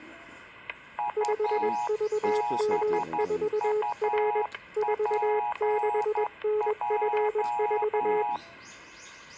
Morse code, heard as two keyed tones, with static crashes and the noise of a park. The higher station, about 11 wpm, 840 Hz: UBUPJ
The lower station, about 21 wpm, 420 Hz: 5VM4R 46NF4